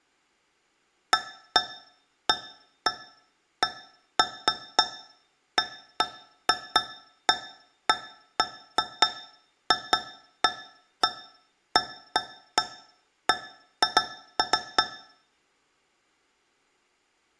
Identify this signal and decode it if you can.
Irregular taps on a metal pipe, with room echo. There is no code.